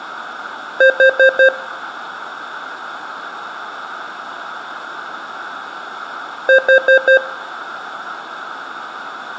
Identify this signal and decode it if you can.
Alarm pattern, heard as an alarm's beeps, played twice, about 530 Hz, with room echo. Temporal four. Carbon monoxide.